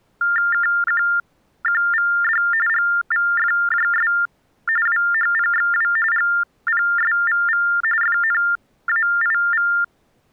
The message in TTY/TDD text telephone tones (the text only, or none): KQQVD GVFJS WHPXW GPSVV FNAIV